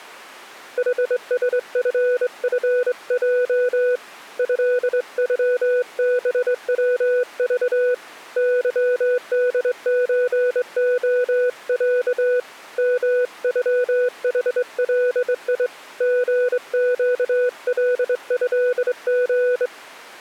Morse code (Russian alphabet), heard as a keyed tone, hand-sent with a straight key, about 23 wpm, 500 Hz. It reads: ХСФФЙ ЭЮБВЖ ЫДЧОЯ МЮХЛИ ГЩЛЭГ